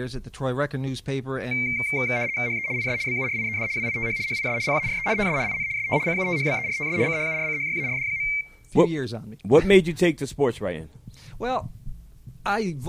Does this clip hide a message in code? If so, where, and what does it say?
Yes: RTTY (75 baud, 170 Hz shift) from 1.5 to 8.4 s, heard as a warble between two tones, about 2200 Hz centre. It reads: HE IS BURIED WITH HIS PARENTS IN ST CUTHBERTS CHURCHYARD.